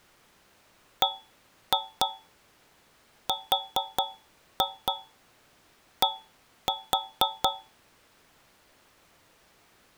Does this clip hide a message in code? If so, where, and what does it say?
Yes: tap code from 1.0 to 7.8 s, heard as taps on a metal pipe, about 4 knocks a second. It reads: BRD